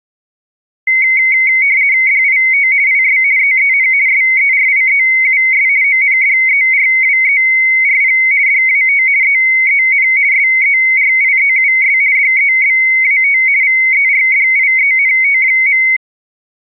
RTTY (50 baud, 170 Hz shift), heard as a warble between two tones, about 2150 Hz centre. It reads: DIT IS EEN SERIEUS ONDERWERP DAT EEN SERIEUS DEBAT VERDIENT.